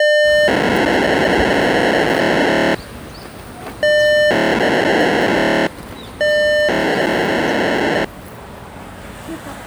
POCSAG pager data (1200 baud), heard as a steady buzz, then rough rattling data, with the noise of a residential street.